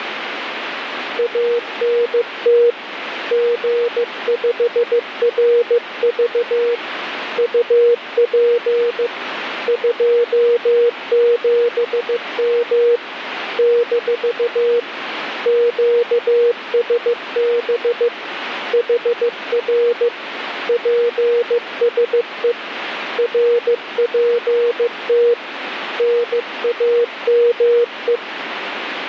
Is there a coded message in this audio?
Yes: Morse code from 1.1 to 28.2 s, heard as a keyed tone, hand-sent with a paddle, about 15 wpm, 480 Hz, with radio static. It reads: ANT G5RV UP 27M - QSB HR PSE RPT NAME